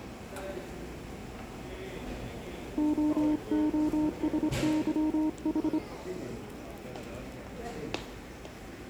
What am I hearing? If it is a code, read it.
Morse code (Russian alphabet), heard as a keyed tone, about 25 wpm, 310 Hz, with the noise of a crowd indoors. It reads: ООСЫХ